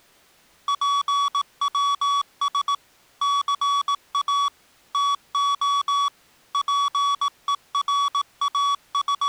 Morse code (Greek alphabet), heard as electronic beeps, machine-sent, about 18 wpm, 1130 Hz. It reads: ΠΩΣ ΘΑ ΤΟ …